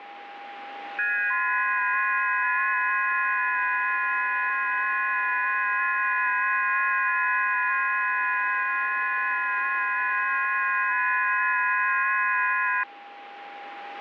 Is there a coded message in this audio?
Yes: FT8 (several signals at once) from 1.0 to 12.8 s, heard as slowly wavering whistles, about 6.25 baud, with radio static and a steady whistle near 810 Hz.